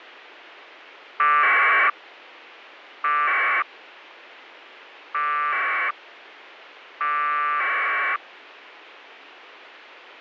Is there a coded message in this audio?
Yes: packet radio (AX.25, as in APRS), 1200 baud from 1.2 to 8.2 s, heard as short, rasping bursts, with radio hiss and a squelch burst at the end.